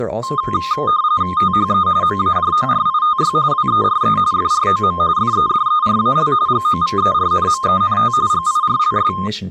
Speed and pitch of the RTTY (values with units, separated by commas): 45.45 baud, 170 Hz shift, 1140 Hz centre